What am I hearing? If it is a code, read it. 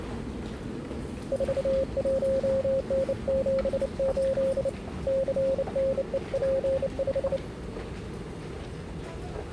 Morse code, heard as a keyed tone, hand-sent with a bug key, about 29 wpm, 540 Hz, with the noise of a subway station. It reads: 41N78 CNEP5